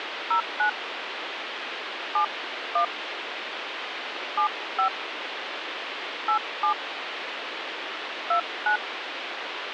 DTMF, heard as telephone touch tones, dialled by hand, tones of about 100 ms, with phone line noise. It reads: 09 71 75 87 29